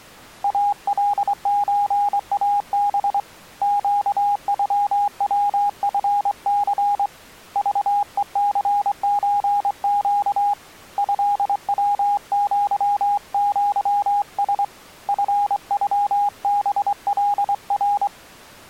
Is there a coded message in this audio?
Yes: Morse code (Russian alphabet) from 0.4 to 18.1 s, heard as a keyed tone, hand-sent with a straight key, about 24 wpm, 820 Hz. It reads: АЛЧАБ ЩЮВФЦ ЖЕЦЧЩ ЭВЪЪС ФЮБЛР